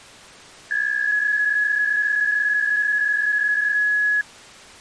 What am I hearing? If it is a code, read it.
PSK63 (62.5 baud), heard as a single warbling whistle, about 1700 Hz.